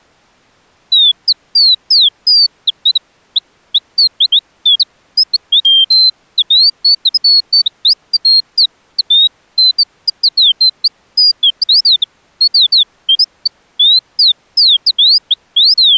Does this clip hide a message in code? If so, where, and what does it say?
No, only bird-like chirps.